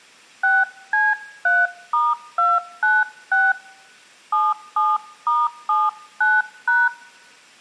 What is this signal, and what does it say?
DTMF, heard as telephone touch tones, dialled by hand, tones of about 210 ms. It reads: 6C3*296 77*79#